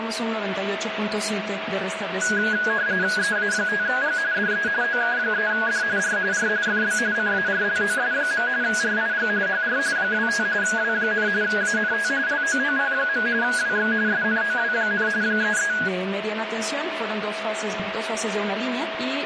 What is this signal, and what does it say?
RTTY (45.45 baud, 170 Hz shift), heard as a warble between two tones, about 1550 Hz centre, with radio static and a steady whistle near 650 Hz. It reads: EA5G DE OK3D R R FB CARLOS. RIG HR 25 W, ANT LOOP. WX SNOW, 33